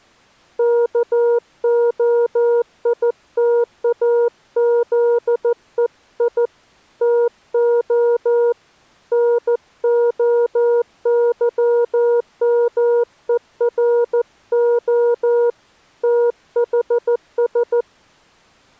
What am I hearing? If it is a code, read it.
Morse code (Greek alphabet), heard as a keyed tone, hand-sent with a paddle, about 14 wpm, 480 Hz. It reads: ΚΟΙΤΑΖΕΙ ΤΟ ΝΟΥΜΕΡΟ ΤΗΣ